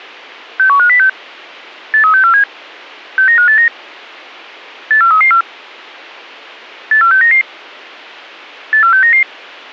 Five-tone selective call (CCIR), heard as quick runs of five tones, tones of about 100 ms. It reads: 61506 83647 69589 84334 84699 84699